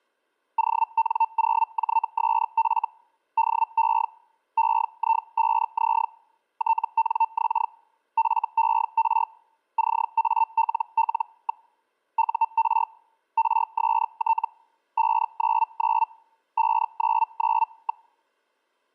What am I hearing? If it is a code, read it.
Hellschreiber (Feld-Hell, 122.5 baud), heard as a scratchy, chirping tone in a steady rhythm, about 900 Hz. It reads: ON0JSF DE EI5Z TNX FER CALL. UR RST 599 599.